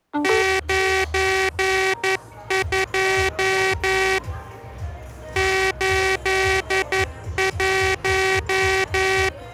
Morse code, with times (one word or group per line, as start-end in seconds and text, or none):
0.2-4.2 92
5.4-9.3 81